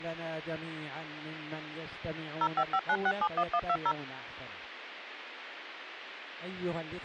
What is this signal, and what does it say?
DTMF, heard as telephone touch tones, dialled by machine, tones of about 60 ms. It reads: 0559671120